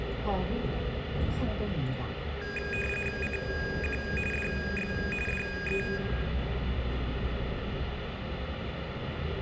RTTY (45.45 baud, 850 Hz shift), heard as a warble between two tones, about 2050 Hz centre, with radio static, room echo and the noise inside a bus. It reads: CQ DX DE